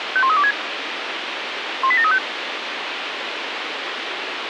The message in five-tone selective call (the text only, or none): 51326 18735